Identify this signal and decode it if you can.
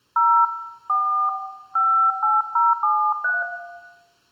DTMF, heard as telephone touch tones, dialled by hand, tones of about 290 ms, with room echo. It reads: 0 4 58073